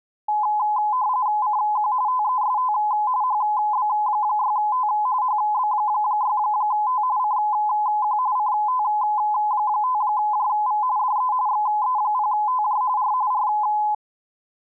RTTY (45.45 baud, 170 Hz shift), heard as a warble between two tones, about 930 Hz centre. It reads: CQ TEST HB6T HB6T CQ CT5JV DE XE0TJ R R